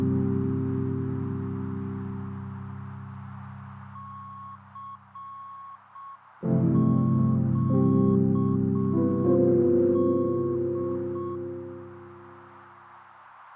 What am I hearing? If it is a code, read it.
Morse code, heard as a keyed tone, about 6 wpm, 1100 Hz, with heavy radio static and a narrow filter. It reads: CQD